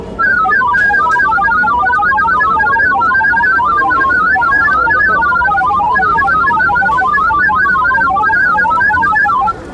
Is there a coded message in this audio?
Yes: multi-tone FSK (Olivia or MFSK type), about 1000 Hz wide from 0.2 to 9.6 s, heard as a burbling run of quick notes, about 31.25 baud, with the noise of a crowd indoors.